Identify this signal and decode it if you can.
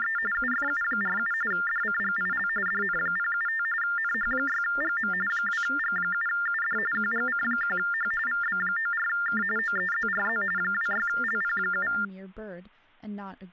TTY/TDD text telephone tones (45.45 baud Baudot), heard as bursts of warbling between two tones, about 400 Hz shift, 1600 Hz centre, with hum and speech in English. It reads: … UFU47 DCGIL DN075 NH6GM 2G7UD QGC1H VB94K OEZRZ 26LP7